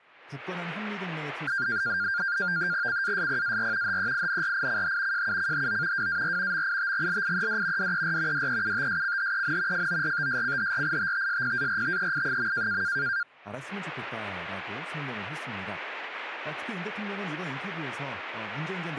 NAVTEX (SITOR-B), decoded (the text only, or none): CASPAR HEINRICH JUCHO WAR MITGLIED DER DEUTSCHEN FORTSCHRITTSPARTEI.